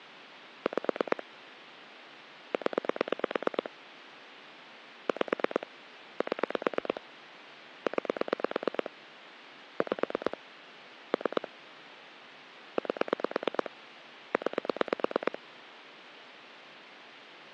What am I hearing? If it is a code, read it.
Pulse dialling, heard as clicks on a phone line, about 9 pulses a second. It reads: 5 0 5 7 9 5 3 8 9